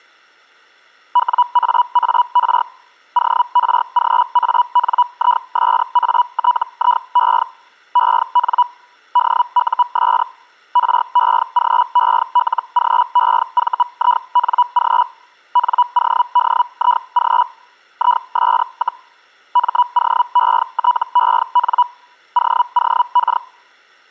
Hellschreiber (Feld-Hell, 122.5 baud), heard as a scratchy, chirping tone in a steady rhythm, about 980 Hz. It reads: WAAR ORGANISATIE EN DUS REGELGEVING NODIG IS, MOETEN OOK